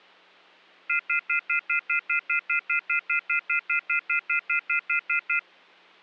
Telephone call progress tone (North American plan), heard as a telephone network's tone, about 1400, 2050, 2450, 2600 Hz, 0.1 s on and 0.1 s off. Off-hook warning tone.